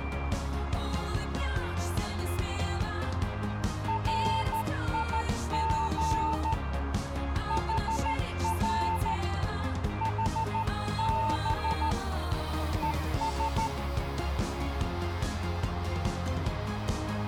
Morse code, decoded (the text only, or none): RIG HR HB ES